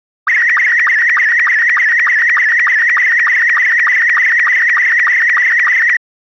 SSTV (slow-scan television), Robot 72, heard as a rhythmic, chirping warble.